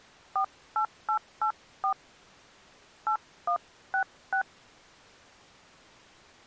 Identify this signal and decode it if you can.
DTMF, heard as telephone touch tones, dialled by hand, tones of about 90 ms. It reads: 48884 8166